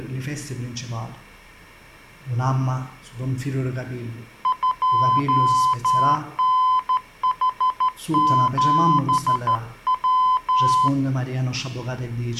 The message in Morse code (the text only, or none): 2NH7W